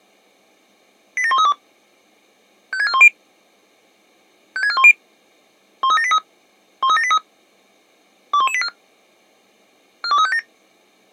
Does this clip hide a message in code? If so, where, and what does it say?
Yes: five-tone selective call (ZVEI) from 1.2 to 10.4 s, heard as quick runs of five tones, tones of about 70 ms. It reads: 87132 56410 56410 13783 13783 21184 42357